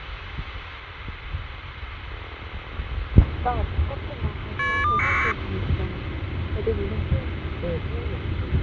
Caller ID data burst, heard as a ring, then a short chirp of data, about 1200 baud, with phone line noise and the noise inside a car.